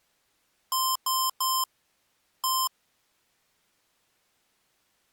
Beep code, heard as beeps from a small speaker, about 1040 Hz. 3-1.